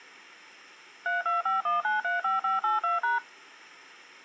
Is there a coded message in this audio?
Yes: DTMF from 1.1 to 3.2 s, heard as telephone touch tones, dialled by machine, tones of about 150 ms. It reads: 3251935582#